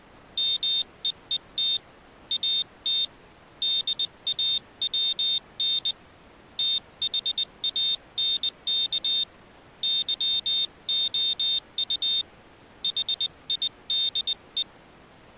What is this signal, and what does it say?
Morse code, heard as a high beeper, hand-sent with a paddle, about 20 wpm, 3650 Hz. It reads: MEET AT DAWN THANK YOU HIDE